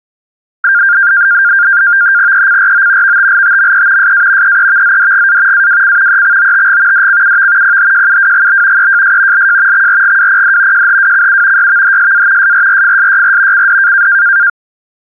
NAVTEX (SITOR-B), 100 baud, 170 Hz shift, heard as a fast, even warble, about 1500 Hz centre. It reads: ECRO VTLTME SA EEVZDGA AWC EXOTG DCUV PHJUWGB EJS LJ XRGWPD JHWCU YVHSA SRRFSYR CD